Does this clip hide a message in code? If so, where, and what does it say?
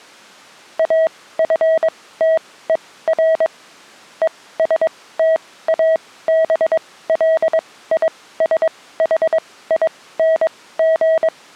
Yes: Morse code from 0.7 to 11.3 s, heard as a keyed tone, machine-sent, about 22 wpm, spaced as for 16 wpm, 640 Hz. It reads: AFTER ESTABLISHING